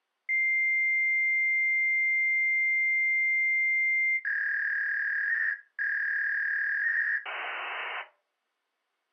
Fax machine handshake, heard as a long tone, a warble and hiss.